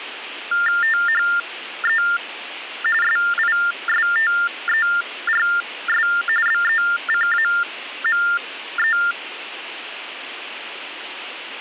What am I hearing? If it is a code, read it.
TTY/TDD text telephone tones (45.45 baud Baudot), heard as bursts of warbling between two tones, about 400 Hz shift, 1600 Hz centre. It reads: THE SISTERS BECAME